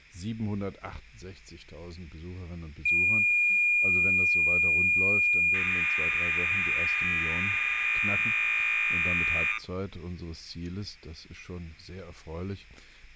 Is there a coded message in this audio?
Yes: cassette data (Kansas City type), 1200 baud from 2.9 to 9.6 s, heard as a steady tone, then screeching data.